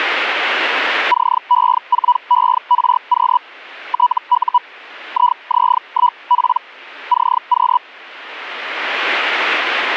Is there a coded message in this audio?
Yes: Hellschreiber (Feld-Hell, 122.5 baud) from 1.1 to 7.8 s, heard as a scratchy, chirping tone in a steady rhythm, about 980 Hz. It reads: CE4ERQ TU IZ1P CQ